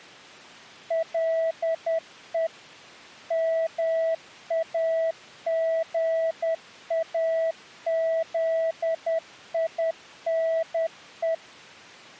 Morse code, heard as a keyed tone, machine-sent, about 10 wpm, 650 Hz. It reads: LE MAGAZINE